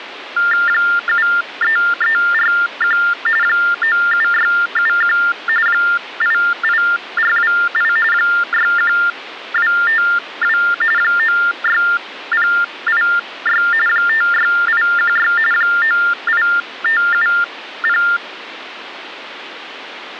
TTY/TDD text telephone tones (45.45 baud Baudot), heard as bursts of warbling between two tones, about 400 Hz shift, 1600 Hz centre, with phone line noise. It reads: 73341 97671 88428 61252 96086 56816 98570